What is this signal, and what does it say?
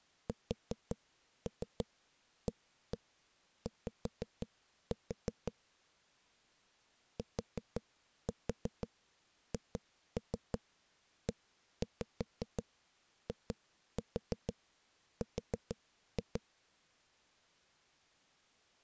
Tap code, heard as knocks on a wall, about 5 knocks a second. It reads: SAY THEIR